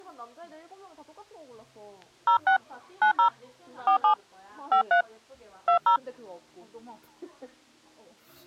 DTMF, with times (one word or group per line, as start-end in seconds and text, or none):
2.3-2.6 06
3.0-3.3 90
3.9-4.1 47
4.7-5.0 53
5.7-6.0 20